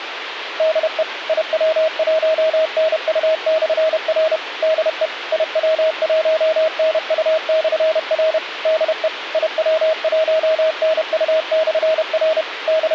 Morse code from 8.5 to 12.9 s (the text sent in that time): DE IW1NU/R …